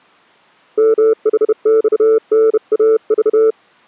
Morse code, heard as a keyed tone, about 31 wpm, 440 Hz. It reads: MHXNAV